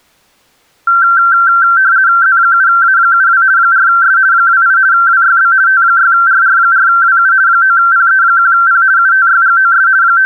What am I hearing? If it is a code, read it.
RTTY (50 baud, 170 Hz shift), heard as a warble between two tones, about 1460 Hz centre. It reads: Z7A72 4S 28 WYB T6RR4WU 9PE1P UTYGOS …